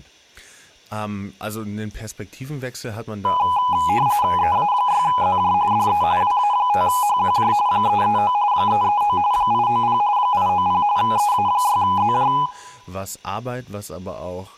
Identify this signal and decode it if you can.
RTTY (45.45 baud, 170 Hz shift), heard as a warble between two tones, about 910 Hz centre, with speech in German. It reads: EA6ZJ DE WA5HQJ 339 339 890 890 EA6ZJ